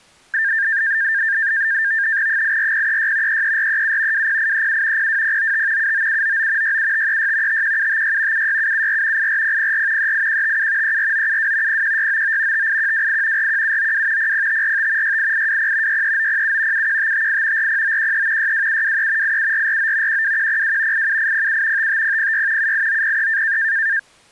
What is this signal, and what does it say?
NAVTEX (SITOR-B), 100 baud, 170 Hz shift, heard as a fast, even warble, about 1700 Hz centre. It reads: 84036 33437 20837 02095 79799 67536 51756 76774 84004 38157 34972 01699 58128 41792 00545 68820 63907 71558 40913 62723 87449 12102 87807 55006 78903